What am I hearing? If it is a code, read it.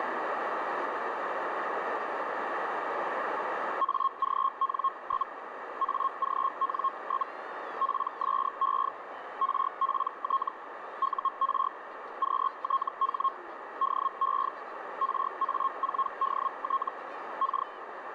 Hellschreiber (Feld-Hell, 122.5 baud), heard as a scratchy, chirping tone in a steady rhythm, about 1080 Hz, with radio static and a narrow filter. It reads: AGN? AGN? PSE RPT UR QTH DE RA4DT K